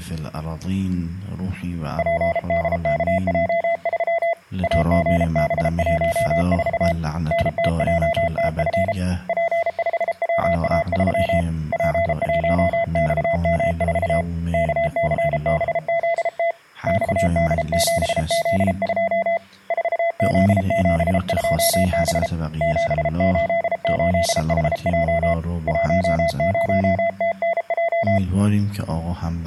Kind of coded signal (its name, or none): Morse code